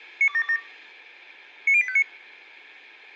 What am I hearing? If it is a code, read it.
Five-tone selective call (ZVEI), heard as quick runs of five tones, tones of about 70 ms. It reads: 92727 90859